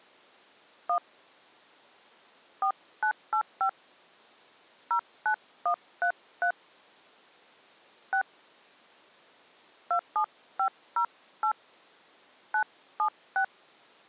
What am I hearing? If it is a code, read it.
DTMF, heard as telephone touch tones, dialled by hand, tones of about 90 ms. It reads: 1 4985 09133 6 27508 976